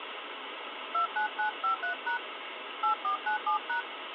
DTMF, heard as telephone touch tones, dialled by hand, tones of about 110 ms, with phone line noise. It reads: 29953# 8497#